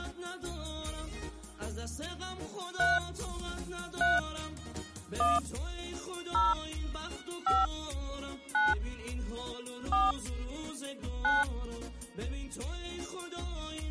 DTMF, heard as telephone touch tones, dialled by hand, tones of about 190 ms. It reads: 3 3 1 0 5 9 4 9